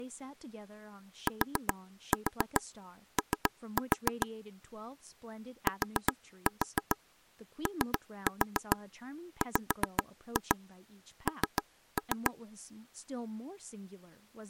Tap code, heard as taps on a table, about 7 knocks a second, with speech in English. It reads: TO TOWN